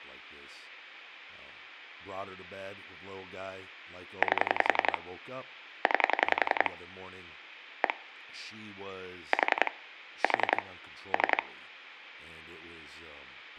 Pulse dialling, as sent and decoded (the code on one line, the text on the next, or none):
8 / 9 / 1 / 4 / 4 / 3
8 9 1 4 4 3